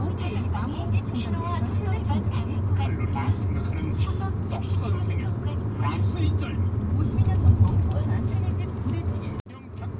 The noise inside a car. There is no code.